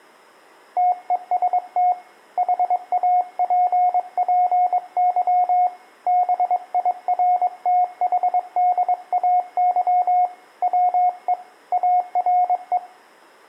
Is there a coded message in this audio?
Yes: Morse code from 0.7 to 12.8 s, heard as a keyed tone, hand-sent with a bug key, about 22 wpm, 720 Hz, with room echo. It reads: TEST HAPPY BIRTHDAY WE ARE